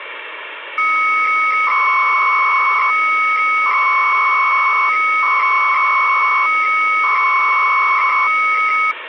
300-baud modem data (Bell 103 tones), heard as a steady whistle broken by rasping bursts, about 300 baud, 200 Hz shift, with phone line noise.